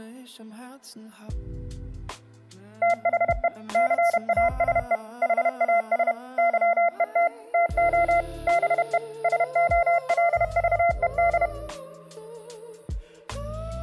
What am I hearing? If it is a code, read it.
Morse code, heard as a keyed tone, machine-sent, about 31 wpm, 690 Hz, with room echo. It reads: THE CASE HAS YET TO BE SOLVED